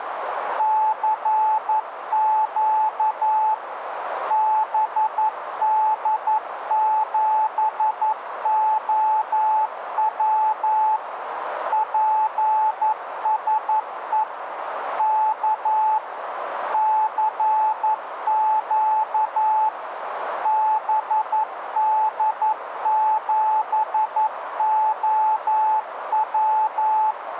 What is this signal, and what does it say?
Morse code, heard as a keyed tone, machine-sent, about 11 wpm, 870 Hz, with radio static and a narrow filter. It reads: CQ BD7OW PSE K CQ BD7OW